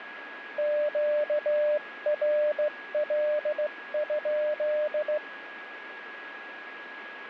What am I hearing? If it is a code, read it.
Morse code, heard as a keyed tone, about 16 wpm, 600 Hz, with radio static and a steady whistle near 1660 Hz. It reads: QRL?